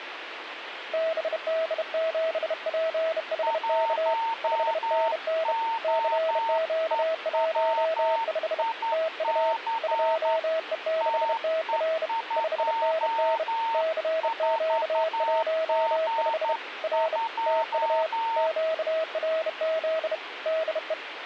Morse code, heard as two keyed tones, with radio static. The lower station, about 31 wpm, 640 Hz: BD7PHK 5NN CQ15 TU 2E6TR 5NN CQ15 R TU QRZ DE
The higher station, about 11 wpm, 910 Hz: 1OEWIC TE24G2